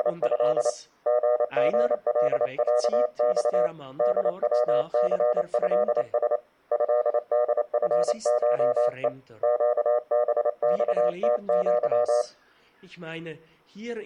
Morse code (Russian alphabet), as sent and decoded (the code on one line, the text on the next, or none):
… / --. --. .-.. .-.- -..- / -.. .-- -.-. ..-.. ... / ..-.. -.. ..-. ---- . / --.- -... -..- - --.--
… ГГЛЯЬ ДВЦЭС ЭДФШЕ ЩБЬТЪ